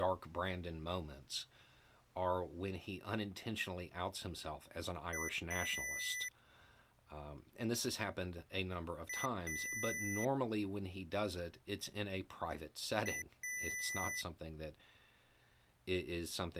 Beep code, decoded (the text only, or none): 1 short, 1 long